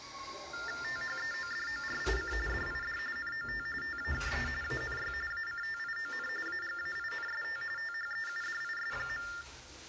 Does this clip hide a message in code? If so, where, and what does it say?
Yes: TTY/TDD text telephone tones (45.45 baud Baudot) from 0.5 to 9.4 s, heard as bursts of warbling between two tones, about 400 Hz shift, 1600 Hz centre, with hum and the noise of a restroom. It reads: THEODORIC DID NOT TAKE ANY ACTION AGAINST THEUDIS.